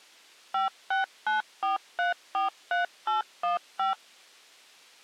DTMF, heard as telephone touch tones, dialled by machine, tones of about 140 ms. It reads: 5694343815